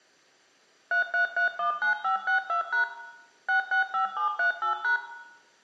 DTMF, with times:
0.9-2.8 33319562#
3.5-5.0 665738#

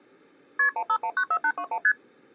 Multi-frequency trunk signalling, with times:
0.6-0.7 KP
0.8-1.8 15194821
1.8-1.9 ST

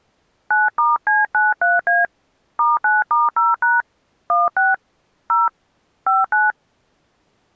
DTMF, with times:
0.5-2.0 9*C93A
2.6-3.8 *9*0#
4.3-4.7 16
5.3-5.5 0
6.1-6.5 59

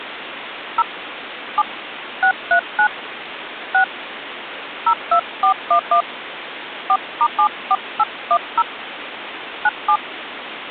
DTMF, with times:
0.8-0.8 0
1.6-1.6 7
2.2-2.9 639
3.7-3.8 6
4.9-6.0 02411
6.9-8.6 4*74810
9.6-10.0 97

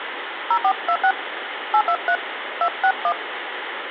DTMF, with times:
0.5-1.1 0426
1.7-2.2 823
2.6-3.1 261

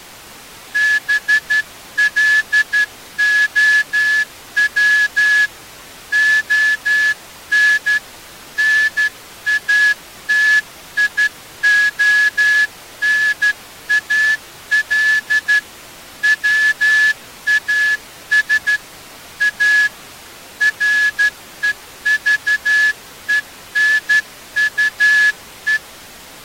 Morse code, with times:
0.8-5.5 BLOW
6.1-8.0 ON
8.6-15.6 NATIONAL
16.2-18.8 WAS
19.4-19.9 A
20.6-25.8 REVENUE

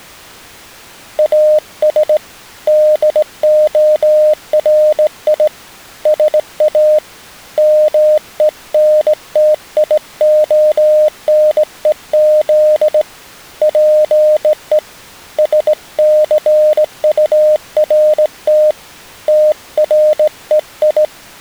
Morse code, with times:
1.2-2.2 AS
2.7-5.5 DORI
6.1-7.0 SA
7.6-13.0 MENTIONEZ
13.6-14.8 PE
15.4-18.7 SCURT
19.3-21.0 TREI

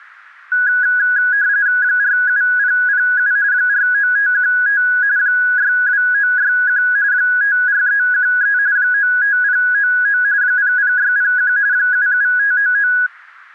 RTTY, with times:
1.8-3.3 47007
3.5-4.8 49515
5.2-6.8 62961
7.1-8.6 54313
8.8-10.2 95099
10.4-11.5 00601
11.7-12.9 77599

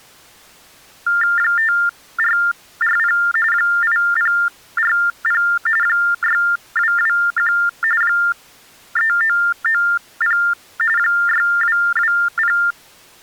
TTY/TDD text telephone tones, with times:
1.4-3.2 5440
3.5-5.4 8040
5.8-7.5 6221
8.0-10.4 3990
11.0-12.6 6220

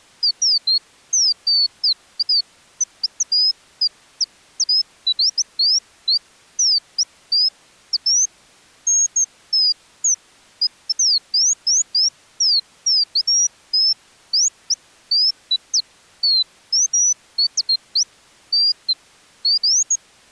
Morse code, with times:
none

